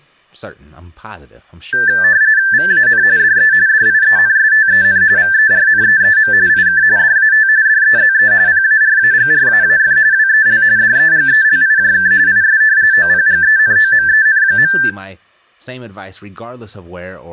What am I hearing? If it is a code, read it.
RTTY (45.45 baud, 170 Hz shift), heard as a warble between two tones, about 1650 Hz centre, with room echo and speech in English. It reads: VAN DE DIENSTEN VERNEEM IK DAT DEZE PARAGRAAF WEL DEGELIJK IS OPGENOMEN.